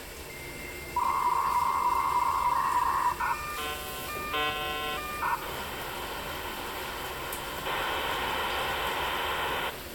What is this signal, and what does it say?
Dial-up modem handshake (V.34 or later), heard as a whistle, warbles, then hiss, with room echo and the noise of a restroom.